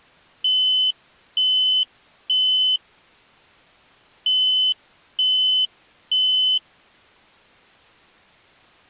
Alarm pattern, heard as an alarm's beeps, played twice, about 3050 Hz. Temporal three. Smoke or fire, evacuate.